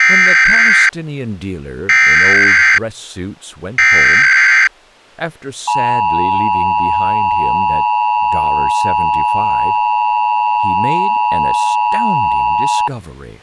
Emergency Alert System (SAME) tones (header bursts, then the 853 and 960 Hz attention tone), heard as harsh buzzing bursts, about 520.83 baud, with speech in English.